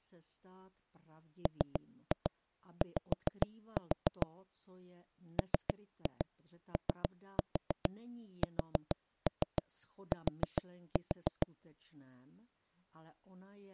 Tap code, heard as knocks on wood, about 7 knocks a second, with speech in Czech. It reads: MY MOST